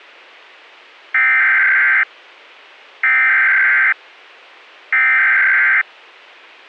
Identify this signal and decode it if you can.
Emergency Alert System (SAME) tones (header bursts), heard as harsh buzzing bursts, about 520.83 baud.